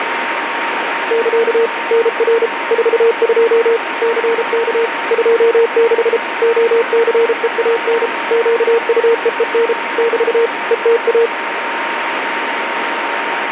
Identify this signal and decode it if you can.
Morse code, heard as a keyed tone, machine-sent, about 33 wpm, 460 Hz, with radio static and a steady whistle near 930 Hz. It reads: <KA> NR 42 CK 26 OCEAN QUEEN <BT> ETA